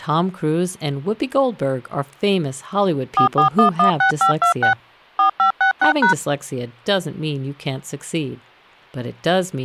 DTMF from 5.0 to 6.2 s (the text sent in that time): 4566#